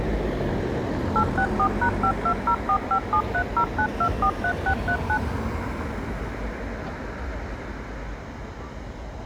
DTMF, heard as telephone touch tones, dialled by machine, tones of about 80 ms, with the noise of a residential street. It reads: 864#520457309243639